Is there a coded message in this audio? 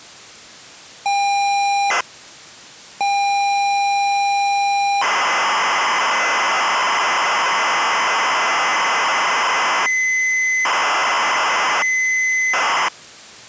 Yes: ZX Spectrum tape loading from 1.1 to 12.9 s, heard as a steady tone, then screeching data.